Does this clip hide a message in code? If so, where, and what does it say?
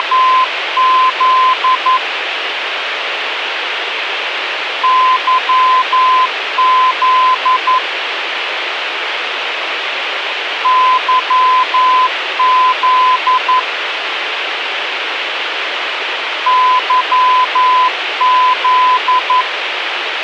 Yes: Morse code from 0.0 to 19.5 s, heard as a keyed tone, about 11 wpm, 1020 Hz, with radio hiss. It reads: … YZ YZ YZ